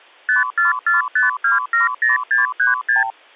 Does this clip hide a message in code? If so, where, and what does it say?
Yes: multi-frequency trunk signalling (R2, with the far end's replies) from 0.3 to 3.1 s, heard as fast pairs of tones, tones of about 140 ms. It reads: 5445270636